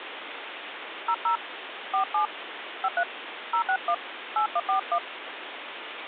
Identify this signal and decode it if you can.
DTMF, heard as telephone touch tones, dialled by hand, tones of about 80 ms, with phone line noise. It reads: 00 47 53 061 8141